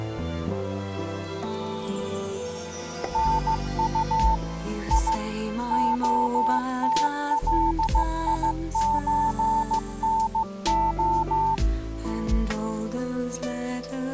Morse code (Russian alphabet), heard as a keyed tone, machine-sent, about 15 wpm, 890 Hz. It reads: НУ И ОТЛИЧНО